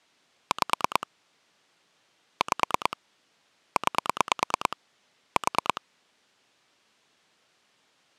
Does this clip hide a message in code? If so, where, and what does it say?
Yes: pulse dialling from 0.5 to 5.8 s, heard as clicks on a phone line, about 9 pulses a second. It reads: 5 5 9 4